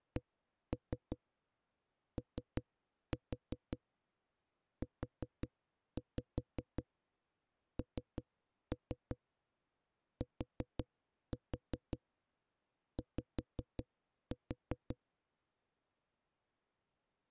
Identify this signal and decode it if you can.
Tap code, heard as knocks on a wall, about 5 knocks a second. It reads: COUNTY